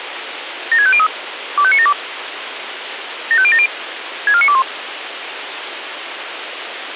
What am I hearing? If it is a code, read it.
Five-tone selective call (ZVEI), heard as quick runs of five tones, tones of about 70 ms, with radio hiss. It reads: 76503 25972 75070 64921